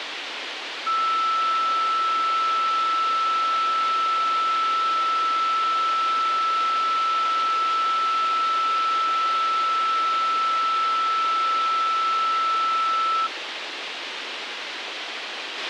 A steady tone, with radio hiss and a squelch burst at the end. There is no code.